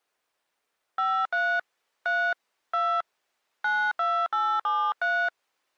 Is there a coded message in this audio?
Yes: DTMF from 1.0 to 5.3 s, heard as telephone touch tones, dialled by hand, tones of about 270 ms. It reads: 53 3 2 92873